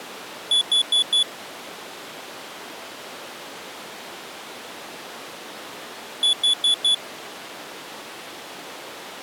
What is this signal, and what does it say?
Alarm pattern, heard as an alarm's beeps, played twice, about 3450 Hz. Temporal four. Carbon monoxide.